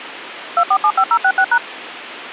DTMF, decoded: 2475066#

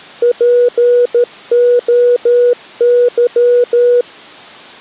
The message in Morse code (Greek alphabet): ΠΟΥ

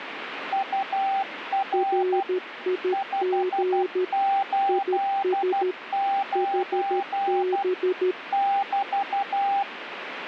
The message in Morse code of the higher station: UR 589 <BT>

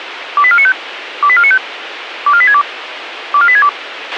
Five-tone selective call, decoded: 28495 28495 24862 24862

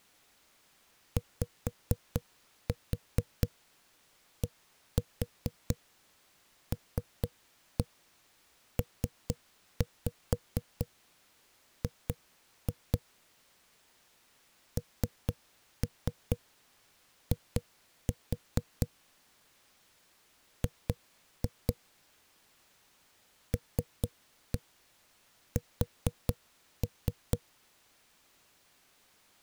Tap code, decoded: YDLPG NI G LS

